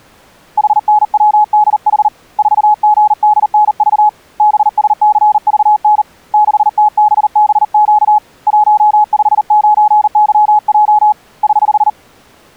Morse code, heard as a keyed tone, hand-sent with a paddle, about 39 wpm, 840 Hz. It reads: HNWDH 4GDNV BSCVN 6TBBQ 159YJ <HH>